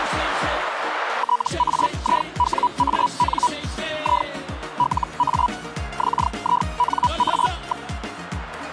Hellschreiber (Feld-Hell, 122.5 baud), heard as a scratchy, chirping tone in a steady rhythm, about 980 Hz. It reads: TAIWAN I LA XINA.